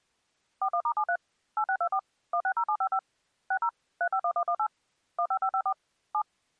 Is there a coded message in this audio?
Yes: DTMF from 0.6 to 6.2 s, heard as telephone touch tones, dialled by machine, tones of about 70 ms. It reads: 41*73 8624 160755 60 351118 15554 7